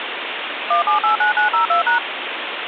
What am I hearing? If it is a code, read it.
DTMF, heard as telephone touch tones, dialled by machine, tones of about 120 ms, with phone line noise. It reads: 1789902#